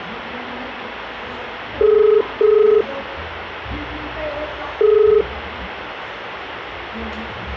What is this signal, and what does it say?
Telephone call progress tone (as in the UK, Ireland, Australia and similar networks), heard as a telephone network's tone, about 430 Hz, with phone line noise and the noise of a park. Ringback tone.